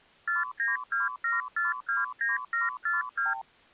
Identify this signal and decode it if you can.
Multi-frequency trunk signalling (R2, with the far end's replies), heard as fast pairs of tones, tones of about 160 ms. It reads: 4927429742